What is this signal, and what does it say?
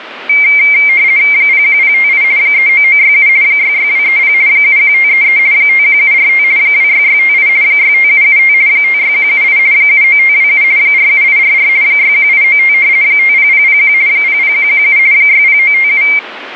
RTTY (50 baud, 170 Hz shift), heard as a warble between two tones, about 2200 Hz centre. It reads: 01058 39967 66230 71533 51745 26658 65775 56178 79527 47844 61895 50001 00117 60957